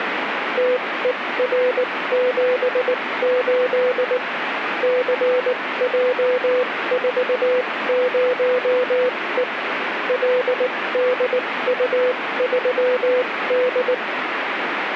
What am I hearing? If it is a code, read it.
Morse code, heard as a keyed tone, machine-sent, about 19 wpm, spaced as for 16 wpm, 500 Hz, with radio static. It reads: TER78 CJ40E LDU3D